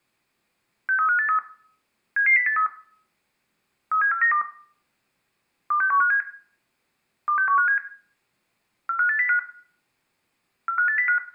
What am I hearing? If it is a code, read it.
Five-tone selective call (CCIR), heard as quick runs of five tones, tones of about 100 ms, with room echo. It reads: 63583 77083 37492 26157 26157 45805 45805